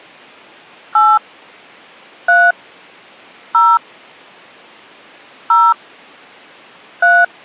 DTMF, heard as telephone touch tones, dialled by hand, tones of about 230 ms. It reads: 8 3 0 0 3